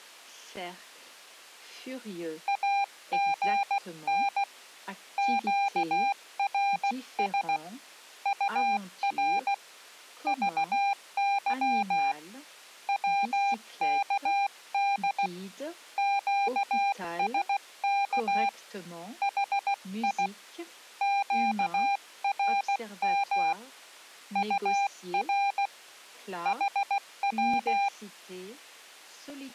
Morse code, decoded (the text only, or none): AGN QRS UR VY WKD QSK HI QRM UR HW